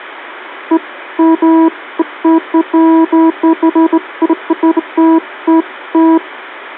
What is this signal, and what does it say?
Beeps of irregular length. There is no code.